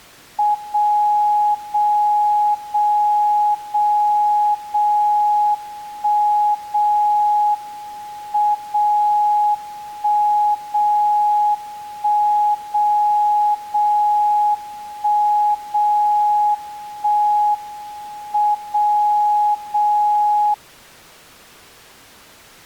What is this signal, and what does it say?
Radio time signal (WWVB), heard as a tone whose level steps once a second, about 840 Hz. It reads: 0 0 0 0 0 1 0 M 0 1 0 1 0 0 1 0 1 M 0 0